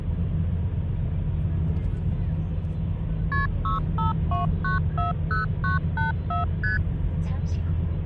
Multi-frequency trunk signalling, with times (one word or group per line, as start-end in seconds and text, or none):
3.3-3.5 KP
3.6-6.4 652940984
6.6-6.8 ST